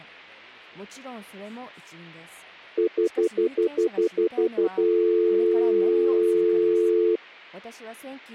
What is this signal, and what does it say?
Telephone call progress tone (North American plan), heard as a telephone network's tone, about 350, 440 Hz, 0.1 s on and 0.1 s off. Stutter dial tone.